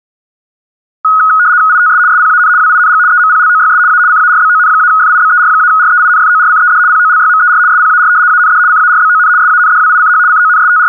RTTY (75 baud, 170 Hz shift), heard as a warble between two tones, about 1360 Hz centre. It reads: ITS SPAN WING EMPLOYS A CARBON-FIBER-REINFORCED POLYMER SPAR AND CARBON SANDWICH …